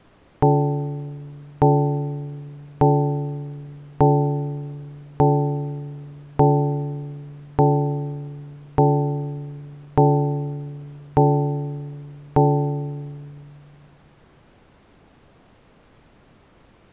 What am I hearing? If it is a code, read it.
Clock strike, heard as a bell. 11. Eleven o'clock.